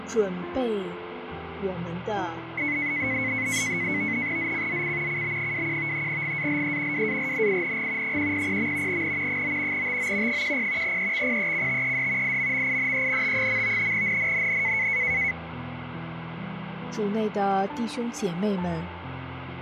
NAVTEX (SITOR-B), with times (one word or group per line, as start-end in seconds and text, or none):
4.4-5.2 ZCZC
5.1-6.1 CB21
6.1-7.1 GALE
6.9-8.2 WARNING
8.0-9.0 100.
8.9-9.4 N
9.3-9.9 9
9.7-10.4 TO
10.3-11.0 10
10.8-12.4 EXPECTED
12.2-13.9 IMMINENT.
13.9-14.9 NNNN